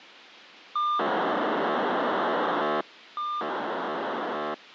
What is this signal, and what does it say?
POCSAG pager data (2400 baud), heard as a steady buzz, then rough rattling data.